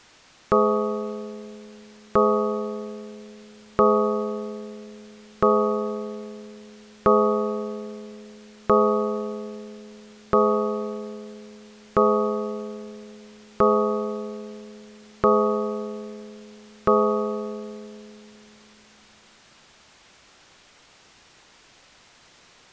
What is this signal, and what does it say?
Clock strike, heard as a bell. 11. Eleven o'clock.